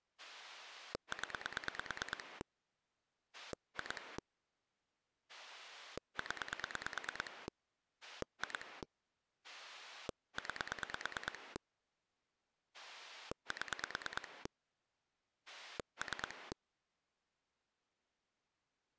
Pulse dialling, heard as a rotary dial, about 9 pulses a second. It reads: 0 2 0 2 9 7 3